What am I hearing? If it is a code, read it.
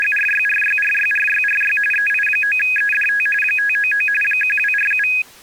RTTY (45.45 baud, 850 Hz shift), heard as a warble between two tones, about 2100 Hz centre. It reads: … EI9EDT 599 1247